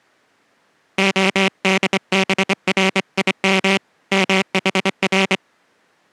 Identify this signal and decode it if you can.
Morse code (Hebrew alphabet), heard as a buzzer, hand-sent with a straight key, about 25 wpm. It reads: הדברים מחר